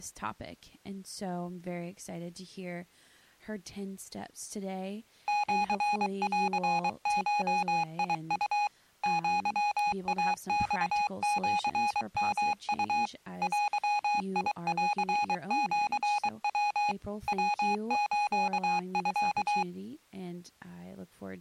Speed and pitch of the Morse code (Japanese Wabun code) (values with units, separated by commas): 23 wpm, 830 Hz